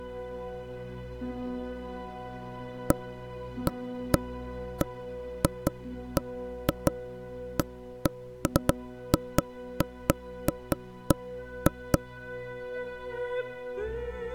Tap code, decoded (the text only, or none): none